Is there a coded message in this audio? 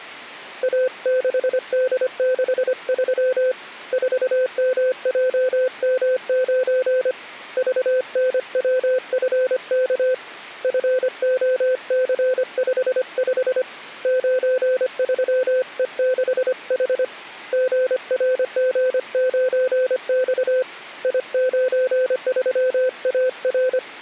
Yes: Morse code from 0.6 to 23.8 s, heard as a keyed tone, hand-sent with a paddle, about 25 wpm, 510 Hz. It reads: A6D63 4MJM9 VNWFK FOC55 93E6H GRG9X I93AR